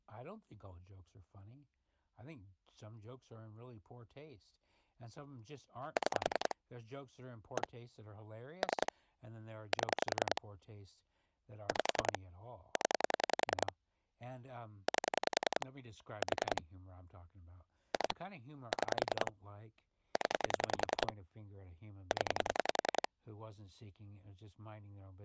Pulse dialling, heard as clicks on a phone line, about 10 pulses a second, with speech in English. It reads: 6 1 3 7 5 0 8 4 2 6 0 0